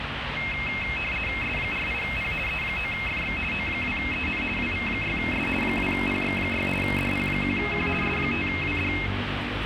RTTY (50 baud, 450 Hz shift), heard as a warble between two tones, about 2350 Hz centre, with radio static and street noise. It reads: S48P E9FX O2EN WV6S 2PX6 DP1Q S5WD